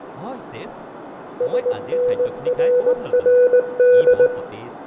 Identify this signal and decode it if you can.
Morse code, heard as a keyed tone, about 19 wpm, 490 Hz, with radio static, fading, a narrow filter, room echo and speech in Assamese. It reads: SNRRD